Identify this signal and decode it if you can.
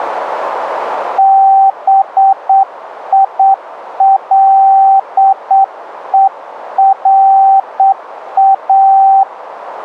Morse code, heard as a keyed tone, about 8 wpm, 780 Hz. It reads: BILERA